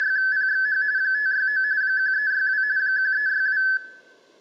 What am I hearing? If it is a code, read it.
RTTY (45.45 baud, 170 Hz shift), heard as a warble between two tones, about 1600 Hz centre, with room echo. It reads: … 569 1362 1362